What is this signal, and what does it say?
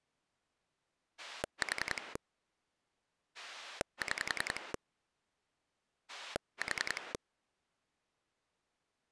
Pulse dialling, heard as a rotary dial, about 10 pulses a second. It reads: 4 6 4